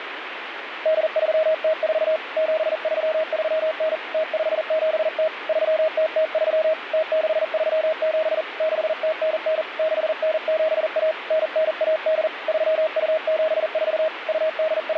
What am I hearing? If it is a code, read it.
Morse code (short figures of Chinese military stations), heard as a keyed tone, hand-sent with a paddle, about 40 wpm, 630 Hz, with radio static. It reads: 8304 7339 0570 3003 0637 6099 6971 9918 3274 …